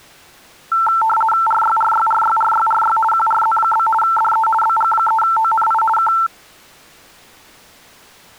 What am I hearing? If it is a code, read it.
RTTY (50 baud, 450 Hz shift), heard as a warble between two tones, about 1120 Hz centre. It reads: RYRYRYRYRY QRZ? DE BG3ONI K